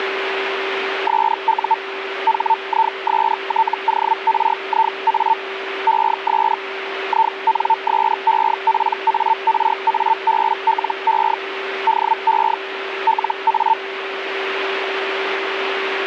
Hellschreiber (Feld-Hell, 122.5 baud), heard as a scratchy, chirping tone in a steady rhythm, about 900 Hz, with radio static and a steady whistle near 390 Hz. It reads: SU HISTORIA ES INSEPARABLE DE LA